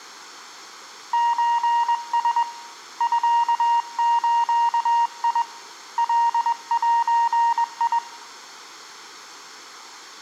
Morse code (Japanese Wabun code), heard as a keyed tone, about 21 wpm, 940 Hz, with room echo. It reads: ソラ ミズ カゼ